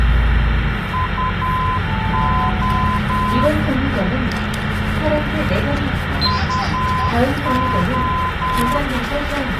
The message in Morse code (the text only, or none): UO UO